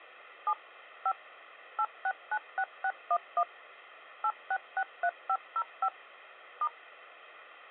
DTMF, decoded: 7 5 8696611 8663505 *

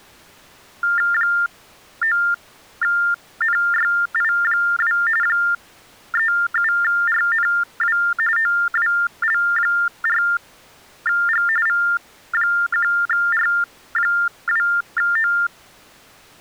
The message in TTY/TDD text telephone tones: 9NYI2 37RNW OWL4G V1R2O

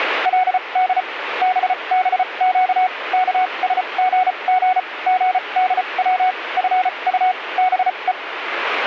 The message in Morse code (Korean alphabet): 그 때였습니다

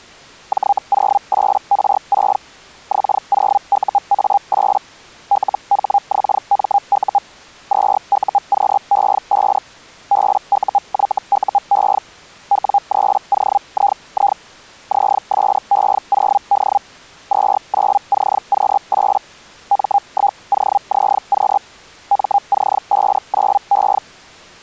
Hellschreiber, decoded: J08R6 X0UA8 LHXMU 2UQE5 BUYUE W3OII ZSE0D 29CQ8 M1OZQ MC59E

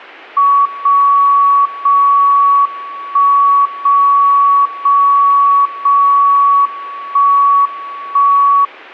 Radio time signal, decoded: 0 0 1 0 0 0 1 1

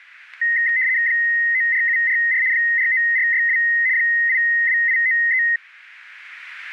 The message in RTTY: 94744 49462 82893

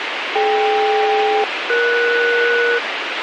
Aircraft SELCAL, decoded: DK-ES

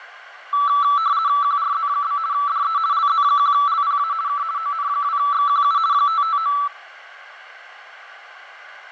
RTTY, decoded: QRZ? DE LZ1LPA K ON2XQU 559

